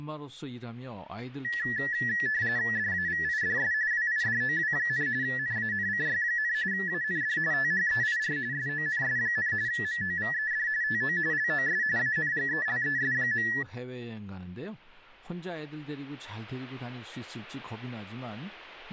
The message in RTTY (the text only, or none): DAVIDS WIDOW, NANCY, AND THEIR SONS, MOVED TO LOS ANGELES.